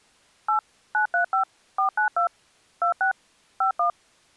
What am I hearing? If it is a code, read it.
DTMF, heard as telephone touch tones, dialled by machine, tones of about 110 ms. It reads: 8 935 492 26 51